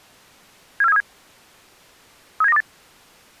Five-tone selective call (EEA), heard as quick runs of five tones, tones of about 40 ms. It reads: 74737 37928